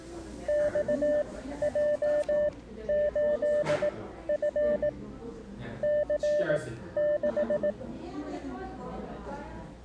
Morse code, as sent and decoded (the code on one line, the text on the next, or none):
-..- .--- ---.. ..-. / -.-. -....
XJ8F C6